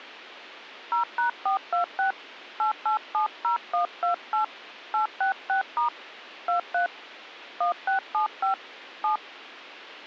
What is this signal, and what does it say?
DTMF, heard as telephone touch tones, dialled by hand, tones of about 120 ms, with a squelch burst at the end. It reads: 0#426 8870128 866* 23 1675 7